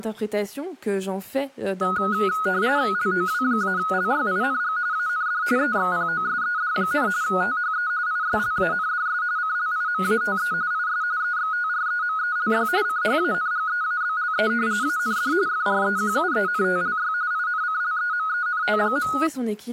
RTTY (45.45 baud, 170 Hz shift), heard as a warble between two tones, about 1360 Hz centre, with speech in French. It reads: LOW-LYING AND EXPOSED, THE ISLANDS CLIMATE IS EXTREMELY CHANGEABLE AND FREQUENTLY INCLEMENT.